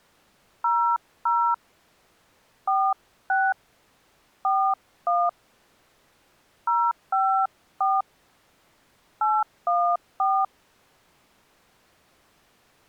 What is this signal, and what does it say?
DTMF, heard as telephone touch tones, dialled by hand, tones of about 260 ms. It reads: 00 46 41 054 814